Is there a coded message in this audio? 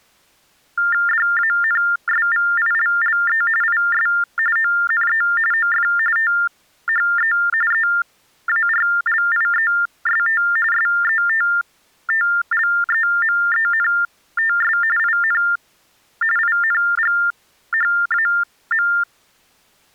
Yes: TTY/TDD text telephone tones (45.45 baud Baudot) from 0.8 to 19.0 s, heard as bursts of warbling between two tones, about 400 Hz shift, 1600 Hz centre. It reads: DANSVILLE IS ONE OF THE EARLIEST SETTLEMENTS IN INGHAM